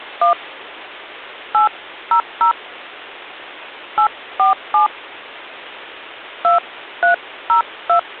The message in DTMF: 1 800 847 2302

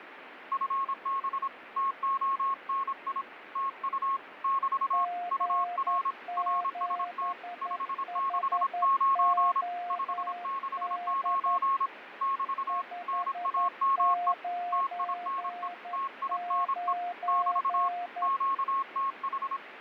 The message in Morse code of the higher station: FB TONI TU <BT> UR RST 569 569 <BT> NAME TINE TINE <BT> QTH

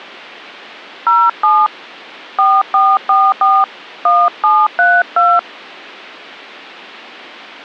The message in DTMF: 07 4444 1732

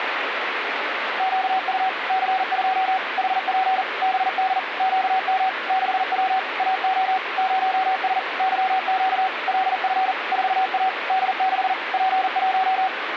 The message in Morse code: QU C2 HP BD QM 6W AO 0S YQ LF 4A D6 P1

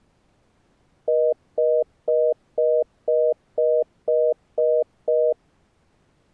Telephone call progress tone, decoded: congestion tone

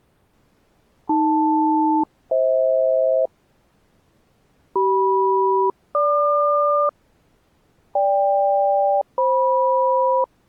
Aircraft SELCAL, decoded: AL-FH CM-GQ GK-FM

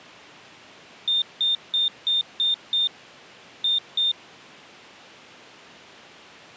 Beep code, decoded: 6-2

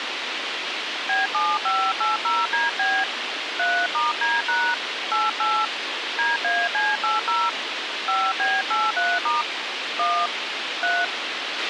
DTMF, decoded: B7580DB 3*D# 88 DAC80 5B83* 1 3

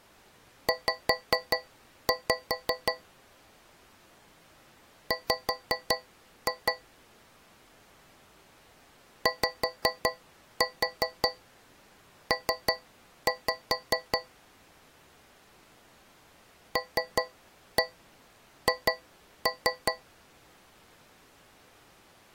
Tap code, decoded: Z W YP LH

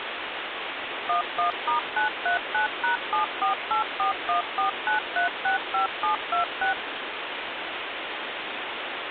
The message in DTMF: 11*939#7484149365726

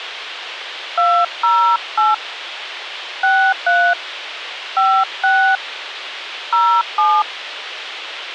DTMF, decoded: 208 63 56 07

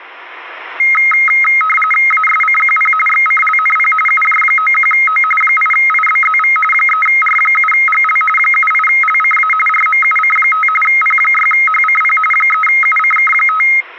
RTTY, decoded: ASCQP XCLNP UJ91O 8IBZV 3R7GL 78LCA RMUC5 P6HCP 3UCK5

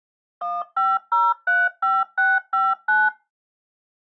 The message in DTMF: 15035659

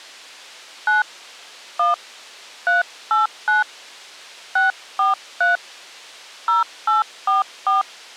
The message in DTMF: 9 1 389 643 0844

